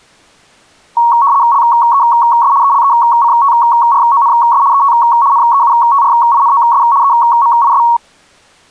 RTTY (75 baud, 170 Hz shift), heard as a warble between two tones, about 1020 Hz centre. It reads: LES ELECTRONS ET NEUTRINOS EMIS